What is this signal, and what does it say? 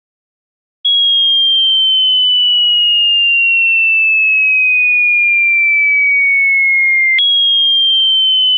A tone that sweeps in pitch again and again. There is no code.